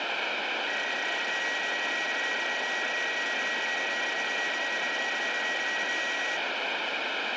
PSK31 (31.25 baud), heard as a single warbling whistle, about 1900 Hz, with radio static.